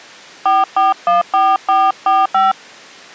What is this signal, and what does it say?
DTMF, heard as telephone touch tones, dialled by hand, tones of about 190 ms. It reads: 4414445